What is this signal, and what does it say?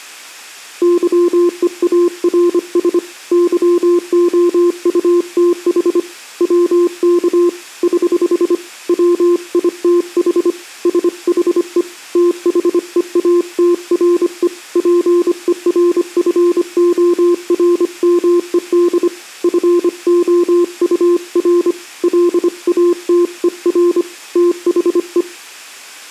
Morse code, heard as a keyed tone, hand-sent with a paddle, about 25 wpm, 350 Hz. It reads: YEARS YOUTH WK <HH> WITH SHE THEATRE PERFORMED FOUR LATER THE